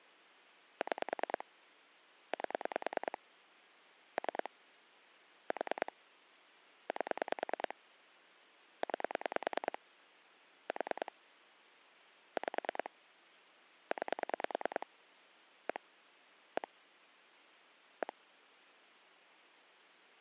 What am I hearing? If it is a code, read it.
Pulse dialling, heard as clicks on a phone line, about 9 pulses a second. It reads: 6 8 3 4 8 9 4 5 9 1 1 1